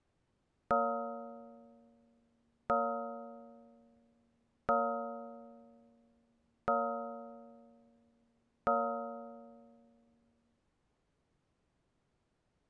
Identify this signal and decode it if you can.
Clock strike, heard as a bell. 5. Five o'clock.